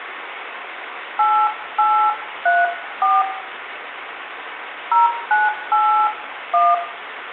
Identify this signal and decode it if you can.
DTMF, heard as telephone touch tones, dialled by hand, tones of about 250 ms, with phone line noise and room echo. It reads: 8834 0981